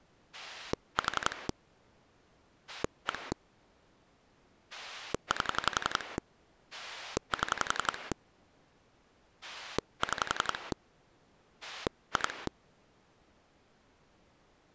Pulse dialling, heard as a rotary dial, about 11 pulses a second. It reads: 4 1 8 7 6 2